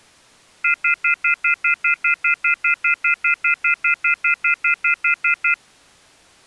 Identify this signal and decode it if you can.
Telephone call progress tone (North American plan), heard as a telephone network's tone, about 1400, 2050, 2450, 2600 Hz, 0.1 s on and 0.1 s off. Off-hook warning tone.